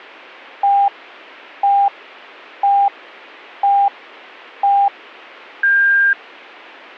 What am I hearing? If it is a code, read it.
Radio time signal (five pips and a higher one, as on Chinese radio), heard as pips.